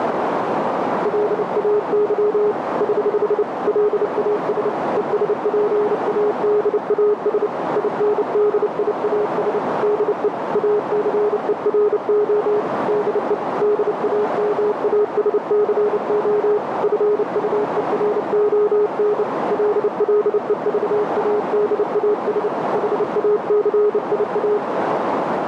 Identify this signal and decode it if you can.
Morse code, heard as a keyed tone, hand-sent with a bug key, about 29 wpm, 420 Hz, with heavy radio static and a narrow filter. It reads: LAY <HH> LAS ESPADAS INDIAS DE ACERO DE DAMASCO FUERON LLEVADAS HACIA